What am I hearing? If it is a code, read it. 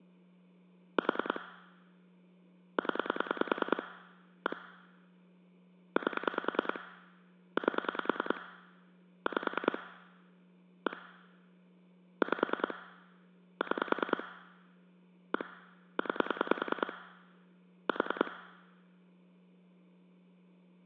Pulse dialling, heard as clicks on a phone line, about 10 pulses a second. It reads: 4 0 1 8 8 5 1 5 6 1 9 4